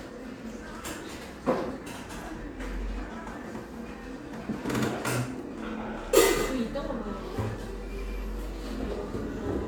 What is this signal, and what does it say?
The noise of a cafe. There is no code.